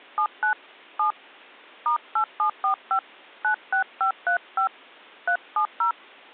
DTMF, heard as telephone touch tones, dialled by hand, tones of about 100 ms. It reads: 79 7 *8745 96535 370